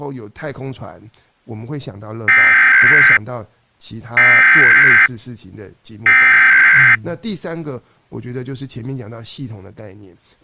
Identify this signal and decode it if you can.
Emergency Alert System (SAME) tones (header bursts), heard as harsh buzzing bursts, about 520.83 baud, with speech in Chinese.